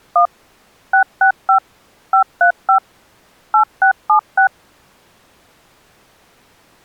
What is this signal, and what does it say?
DTMF, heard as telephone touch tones, dialled by machine, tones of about 100 ms. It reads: 1 665 535 8676